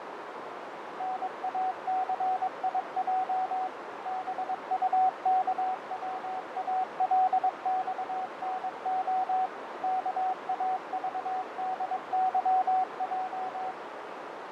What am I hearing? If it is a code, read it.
Morse code (Russian alphabet), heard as a keyed tone, machine-sent, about 22 wpm, 750 Hz, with heavy radio static, fading and a narrow filter. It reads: НАЦИЙ БУКВАЛЬНО КАЖДЫЙ